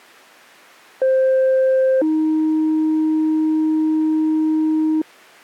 Two-tone page, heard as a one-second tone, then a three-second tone, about 520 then 310 Hz.